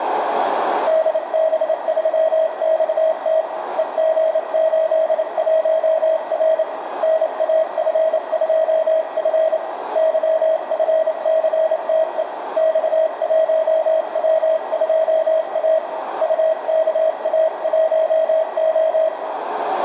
Morse code, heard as a keyed tone, hand-sent with a paddle, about 28 wpm, 640 Hz, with radio static, a narrow filter and room echo. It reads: DB3XT EG81R NAF2F YFCTE X1W2A UKA1O